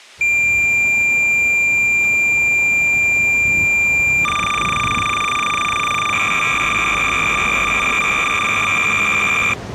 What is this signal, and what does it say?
Cassette data (Kansas City type), 300 baud, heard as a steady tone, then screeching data, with street noise.